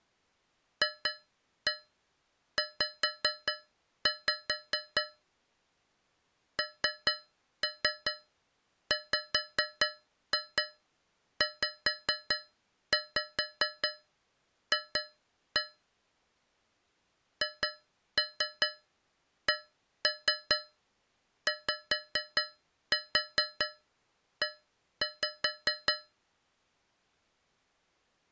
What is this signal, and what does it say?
Tap code, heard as taps on a metal pipe, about 4 knocks a second. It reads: FZ NWZF HCYE